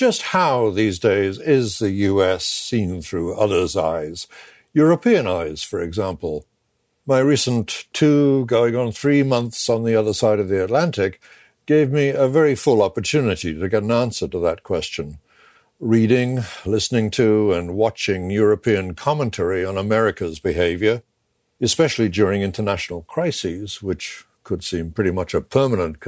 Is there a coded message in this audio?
No.